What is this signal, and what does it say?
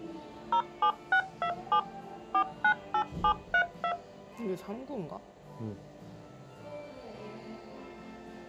DTMF, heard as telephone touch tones, dialled by machine, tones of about 80 ms, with the noise of a cafe. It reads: 07627 498732